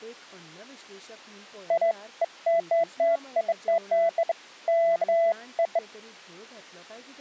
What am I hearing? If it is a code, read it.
Beeps of irregular length, with speech in Goan Konkani. There is no code.